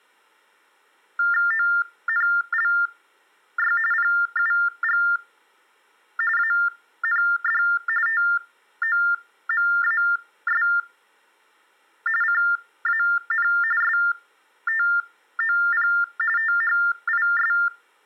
TTY/TDD text telephone tones (45.45 baud Baudot), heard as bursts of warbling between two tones, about 400 Hz shift, 1600 Hz centre. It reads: ONLY PUG AND TOMAS CAN STOP THIS